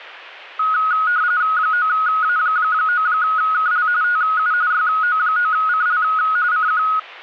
RTTY (45.45 baud, 170 Hz shift), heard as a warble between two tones, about 1360 Hz centre. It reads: 9A9KL TU YO9CL CQ